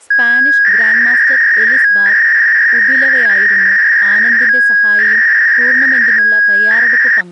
300-baud modem data (V.21 tones), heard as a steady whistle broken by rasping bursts, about 300 baud, 200 Hz shift, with speech in Malayalam.